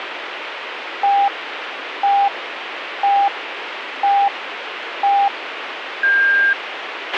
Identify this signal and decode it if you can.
Radio time signal (five pips and a higher one, as on Chinese radio), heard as pips, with radio hiss and a squelch burst at the end.